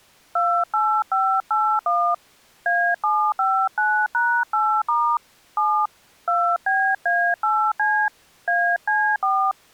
DTMF, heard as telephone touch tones, dialled by hand, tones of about 290 ms. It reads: 28581 A759#8* 7 2BA8C AC4